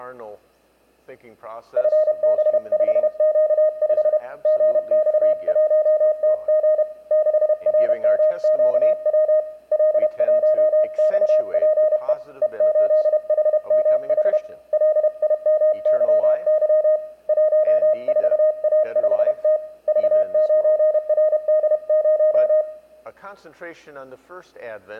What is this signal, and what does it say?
Morse code, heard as a keyed tone, hand-sent with a paddle, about 31 wpm, 620 Hz, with room echo. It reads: FB5Q5 GX1TG 6RMQW L1XPE E8HMH LIMYY 14A5T V9RD0